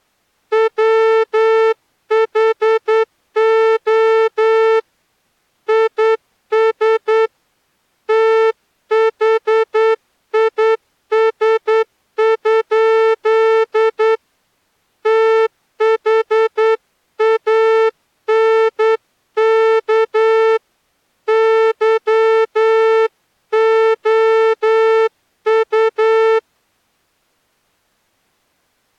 Morse code, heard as a horn, hand-sent with a straight key, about 9 wpm. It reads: WHO IS THIS? THANK YOU